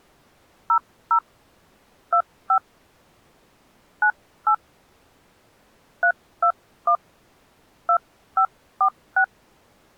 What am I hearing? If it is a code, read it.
DTMF, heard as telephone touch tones, dialled by hand, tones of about 80 ms. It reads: 00 25 98 321 2546